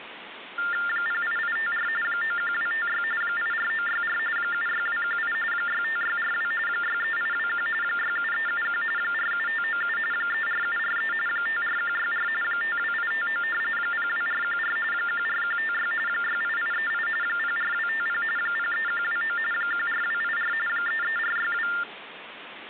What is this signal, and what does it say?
TTY/TDD text telephone tones (45.45 baud Baudot), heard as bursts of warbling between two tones, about 400 Hz shift, 1600 Hz centre, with phone line noise. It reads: 08854 91256 84964 76218 65642 63821 67371 47597 34743 54164 52859 02414 14156 68838 04250 03129 14284 33462